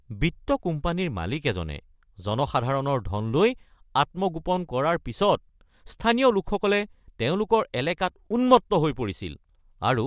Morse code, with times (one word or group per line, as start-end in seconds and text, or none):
none